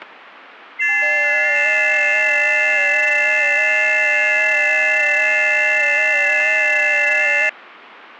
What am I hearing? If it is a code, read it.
FT8 (several signals at once), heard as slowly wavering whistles, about 6.25 baud, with static crashes.